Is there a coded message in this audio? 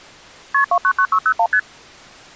Yes: multi-frequency trunk signalling (R1, as on North American trunks) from 0.5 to 1.6 s, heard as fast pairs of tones, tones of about 70 ms. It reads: KP 299601 ST